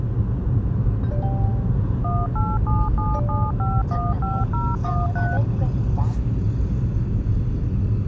DTMF, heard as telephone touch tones, dialled by machine, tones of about 220 ms, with the noise inside a car. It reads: 18777515013